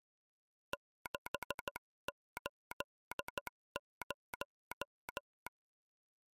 Morse code, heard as a telegraph sounder, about 13 wpm. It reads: 680